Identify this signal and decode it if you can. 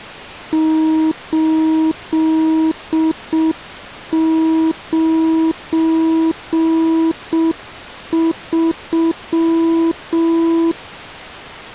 Morse code, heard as a keyed tone, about 6 wpm, 320 Hz. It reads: 893